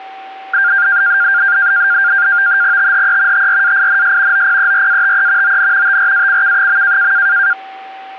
NAVTEX (SITOR-B), 100 baud, 170 Hz shift, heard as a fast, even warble, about 1500 Hz centre, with a steady whistle near 770 Hz. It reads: THE TRAINS OPERATE ON TRACK.